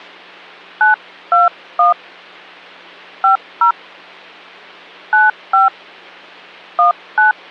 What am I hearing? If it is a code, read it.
DTMF, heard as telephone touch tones, dialled by hand, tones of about 140 ms, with hum. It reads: 921 50 95 19